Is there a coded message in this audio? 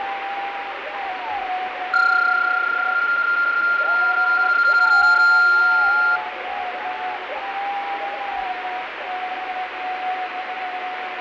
Yes: PSK31 (31.25 baud) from 1.9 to 6.2 s, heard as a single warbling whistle, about 1400 Hz, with radio static.